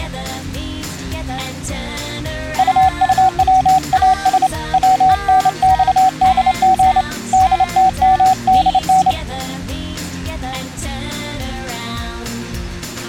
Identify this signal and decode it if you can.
Morse code, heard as a keyed tone, hand-sent with a straight key, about 28 wpm, 750 Hz. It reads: UUWAS WNXDG DTMDN